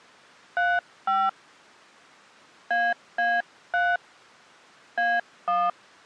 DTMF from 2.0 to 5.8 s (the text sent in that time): AA3 A1